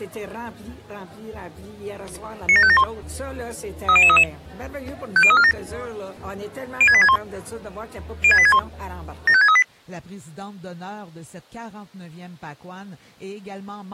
Five-tone selective call (ZVEI), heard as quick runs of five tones, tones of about 70 ms. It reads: 97571 30033 50347 06861 06861 75638